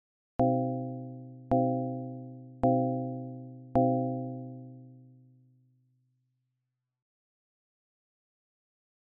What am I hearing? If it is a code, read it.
Clock strike, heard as a bell. 4. Four o'clock.